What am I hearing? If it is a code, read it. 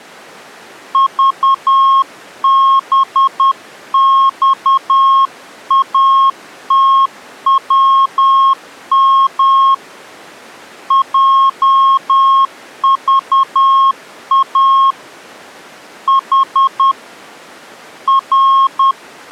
Morse code, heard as a keyed tone, hand-sent with a paddle, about 10 wpm, 1080 Hz. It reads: VBXATWM JVA H …